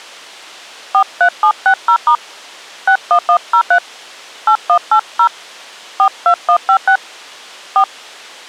DTMF, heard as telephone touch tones, dialled by hand, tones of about 80 ms. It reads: 43760* 61103 8180 42156 4